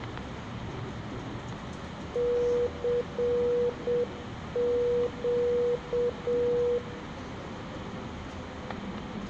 Morse code, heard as a keyed tone, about 7 wpm, 480 Hz, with static crashes, room echo and the noise inside a subway train. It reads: CQ